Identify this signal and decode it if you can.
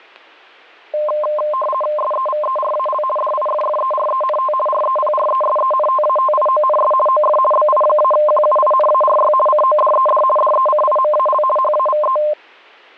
RTTY (50 baud, 450 Hz shift), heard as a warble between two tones, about 830 Hz centre, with static crashes. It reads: SEVERAL DIFFERENT REPRESENTATIONS OF BI-QUINARY CODED DECIMAL HAVE